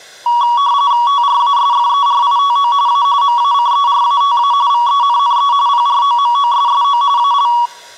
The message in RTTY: TRASFERITO A MACERATA VENNE PROMOSSO AL

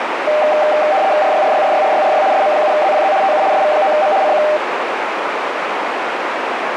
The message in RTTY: RYRYRYRYRY SM7ZPZ TU SV9M CQ

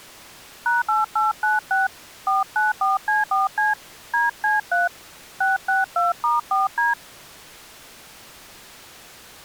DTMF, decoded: #8896 494C4C DC3 662*4D

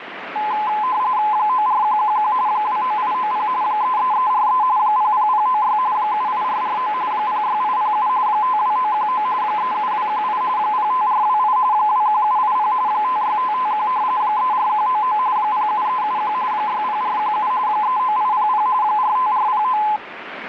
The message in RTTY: 94111 29890 33343 00096 78449 06807 52919 37218 05428 21780 56551 34199 07371 60417 39800 45409

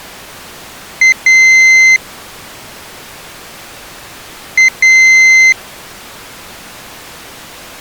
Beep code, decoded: 1 short, 1 long

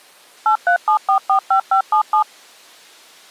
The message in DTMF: 837445577

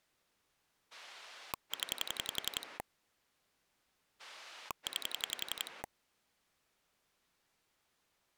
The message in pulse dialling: 0 9

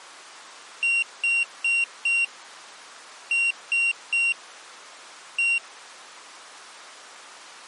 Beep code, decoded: 4-3-1

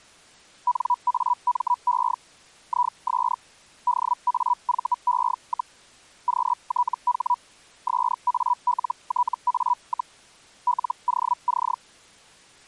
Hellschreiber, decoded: NAME IS DAVE, QTH SALTA, LOC

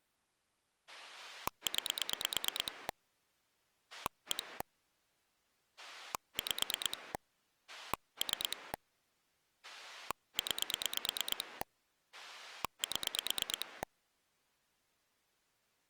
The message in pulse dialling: 9 1 5 3 9 7

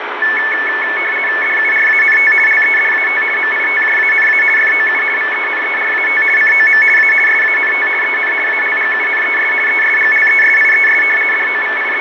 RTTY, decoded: DURANT LEDAT MITJANA FOU VENERAT COM A SANT EN ALGUNES ESGLESIES …

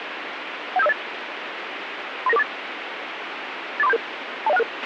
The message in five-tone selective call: 17508 39948 84377 20166

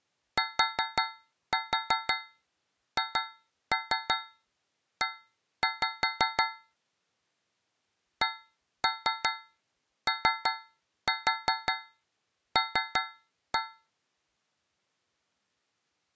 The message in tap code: THE COL

